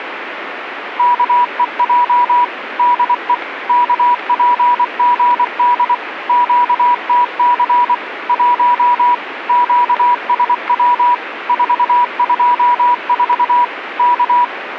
Morse code, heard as a keyed tone, machine-sent, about 24 wpm, 970 Hz, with radio static. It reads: KEJ DE KPGD QTC 1 QSW 424 K